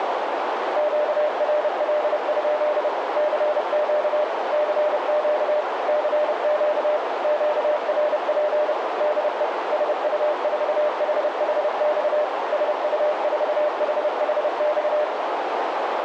Morse code, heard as a keyed tone, machine-sent, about 30 wpm, 600 Hz, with heavy radio static and a narrow filter. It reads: QRL? CQ CQ CQ QRP DE SU4HHX SU4HHX